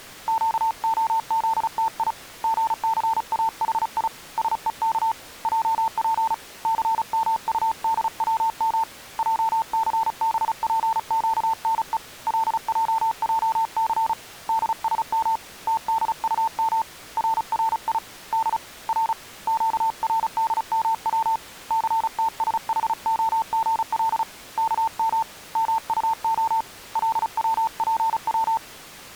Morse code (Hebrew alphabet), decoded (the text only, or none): קהזתי גסאחי שוך עף סמטדצם עסבפקנו לעעס דשם תדטם ררי ד ר קרדמץ סתשחהגל כם מטה לצפץ